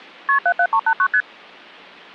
Multi-frequency trunk signalling (R1, as on North American trunks), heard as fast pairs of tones, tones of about 70 ms. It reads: KP 77389 ST